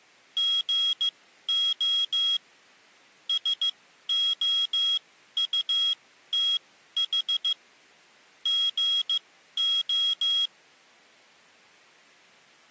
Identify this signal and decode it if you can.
Morse code, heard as a high beeper, machine-sent, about 15 wpm, spaced as for 12 wpm, 3300 Hz. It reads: GO SOUTH GO